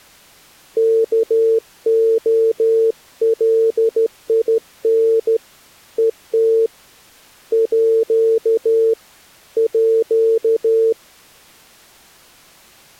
Morse code (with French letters), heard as a keyed tone, hand-sent with a straight key, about 13 wpm, 450 Hz. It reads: KOLIN ET À À